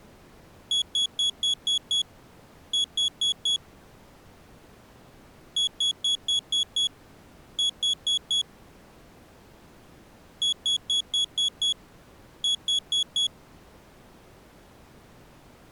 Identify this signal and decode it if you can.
Beep code, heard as a piezo beeper, played three times, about 3350 Hz. 6-4.